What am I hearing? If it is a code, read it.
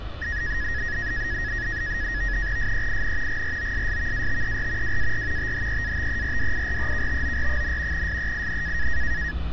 NAVTEX (SITOR-B), 100 baud, 170 Hz shift, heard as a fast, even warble, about 1800 Hz centre, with street noise. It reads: SEIN GROSSVATER WAR THEATERDIREKTOR, SEIN